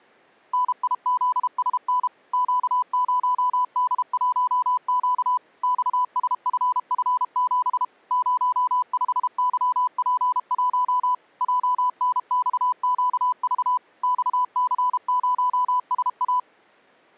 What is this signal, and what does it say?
Morse code, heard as a keyed tone, machine-sent, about 32 wpm, 1000 Hz. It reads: NIZSN Q0D1Q XSFF7 05YP1 JNXQV XC0SA